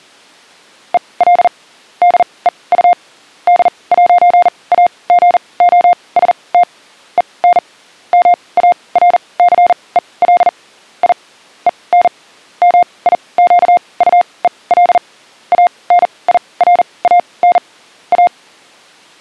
Morse code, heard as a keyed tone, machine-sent, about 40 wpm, spaced as for 25 wpm, 710 Hz. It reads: EL DEU D'AGOST EN MARCEL I EN MIQUEL ANIRAN A